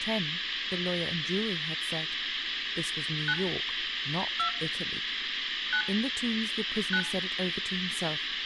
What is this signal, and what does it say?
DTMF, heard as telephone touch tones, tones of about 80 ms, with phone line noise and speech in English. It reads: 9 2 9 9